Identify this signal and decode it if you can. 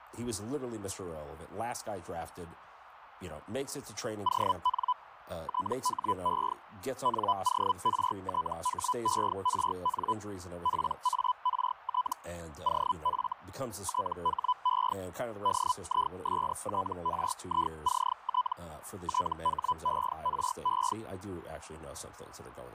Hellschreiber (Feld-Hell, 122.5 baud), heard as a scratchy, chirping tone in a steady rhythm, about 1000 Hz, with radio static and speech in English. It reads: ON THE NORTHERN PART OF THE DISTRICT THERE